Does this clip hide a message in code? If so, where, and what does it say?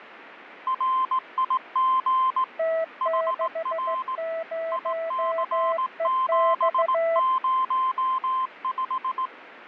Yes: Morse code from 0.6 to 9.3 s, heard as two keyed tones, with radio static. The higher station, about 18 wpm, 1040 Hz: RIG HR IC705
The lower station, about 15 wpm, 660 Hz: T60EX